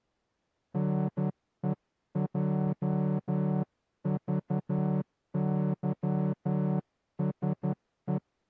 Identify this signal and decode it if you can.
Morse code, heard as a horn, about 11 wpm. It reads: NEJVYSE